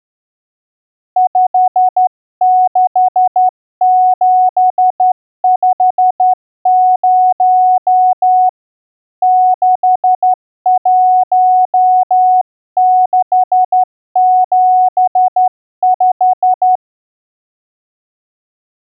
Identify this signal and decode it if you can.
Morse code, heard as a keyed tone, hand-sent with a straight key, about 12 wpm, 740 Hz. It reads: 56750 61675